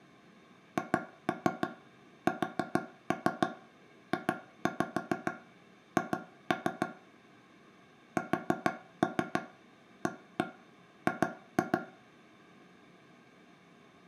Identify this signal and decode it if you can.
Tap code, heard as taps on a table, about 6 knocks a second, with room echo. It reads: HSJH SAG